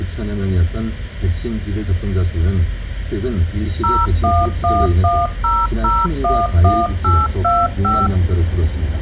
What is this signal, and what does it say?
DTMF, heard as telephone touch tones, dialled by machine, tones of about 220 ms, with the noise inside a car. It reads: 01110011825